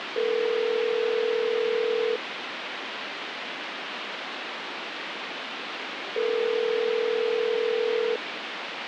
Telephone call progress tone (North American plan), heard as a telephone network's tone, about 440, 480 Hz, 2 s on and 4 s off, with phone line noise. Ringback tone.